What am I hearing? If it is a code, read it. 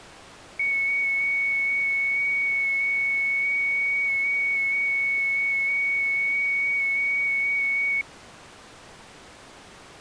FT8 (one signal), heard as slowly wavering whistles, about 6.25 baud.